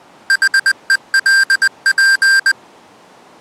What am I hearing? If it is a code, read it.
Morse code, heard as electronic beeps, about 20 wpm, 1600 Hz. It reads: HELP